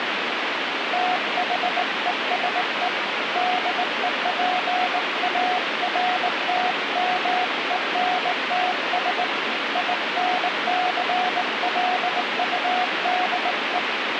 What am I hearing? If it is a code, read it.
Morse code, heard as a keyed tone, hand-sent with a straight key, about 19 wpm, 730 Hz, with radio static. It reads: THESE DEPARTMENTS INCLUDE